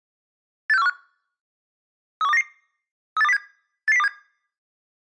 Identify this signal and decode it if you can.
Five-tone selective call (EEA), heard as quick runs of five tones, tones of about 40 ms. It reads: 86415 31299 38207 88027